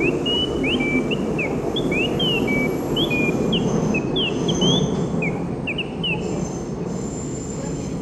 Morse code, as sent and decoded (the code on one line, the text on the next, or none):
none